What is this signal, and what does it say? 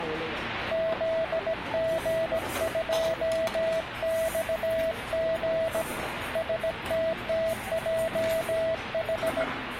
Morse code, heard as a keyed tone, hand-sent with a bug key, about 17 wpm, 650 Hz, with radio static and the noise of a crowd indoors. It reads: ZG2XG STTJH